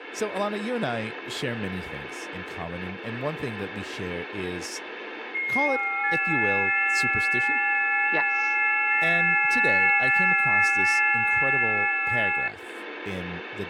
FT8 (several signals at once), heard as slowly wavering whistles, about 6.25 baud, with radio static and speech in English.